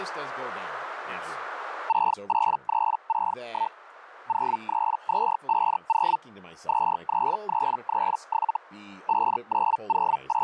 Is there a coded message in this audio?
Yes: Hellschreiber (Feld-Hell, 122.5 baud) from 1.9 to 10.4 s, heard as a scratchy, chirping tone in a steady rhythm, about 900 Hz, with speech in English. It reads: 68361 03250 23337 …